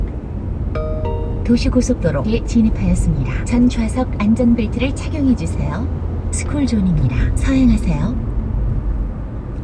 The noise inside a car. There is no code.